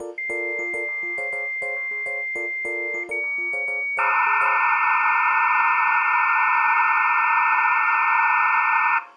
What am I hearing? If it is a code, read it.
Dial-up modem handshake (low-speed, two carriers), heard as two whistles, then hiss, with room echo.